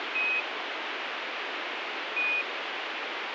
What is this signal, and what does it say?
Quindar tones, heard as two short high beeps, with radio hiss.